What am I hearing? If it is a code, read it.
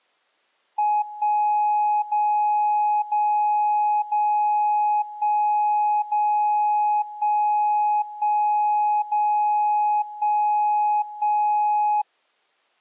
Radio time signal (DCF77), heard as a tone whose level steps once a second, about 840 Hz. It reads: 1 0 0 0 1 0 1 1 0 1 1